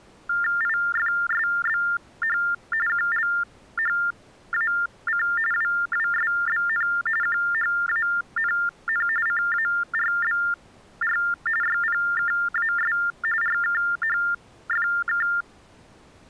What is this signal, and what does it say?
TTY/TDD text telephone tones (45.45 baud Baudot), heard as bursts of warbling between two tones, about 400 Hz shift, 1600 Hz centre. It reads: IFSBH QLHAC WWSBN QHANN CARBR YPKAS RKHFK